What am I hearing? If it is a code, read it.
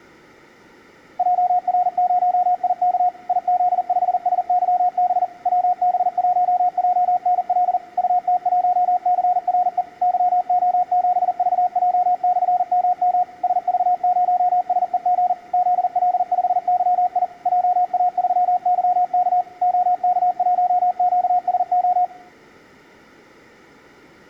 Morse code, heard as a keyed tone, machine-sent, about 40 wpm, 720 Hz, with room echo. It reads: JR0IK IZ5SYB WB1JNL UT1CRE YO7VJ/MM SV0SEG ZL5YI JA3YK OK1QSO